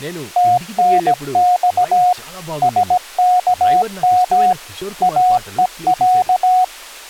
Morse code (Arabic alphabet), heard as a keyed tone, machine-sent, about 17 wpm, 730 Hz, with speech in Telugu. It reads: تنص سكم اءع